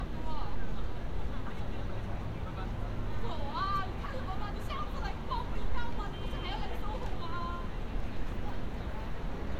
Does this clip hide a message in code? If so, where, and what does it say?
No, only street noise.